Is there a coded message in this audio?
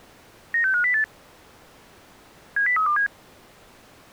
Yes: five-tone selective call (CCIR) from 0.5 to 3.1 s, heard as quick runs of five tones, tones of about 100 ms. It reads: 96508 70327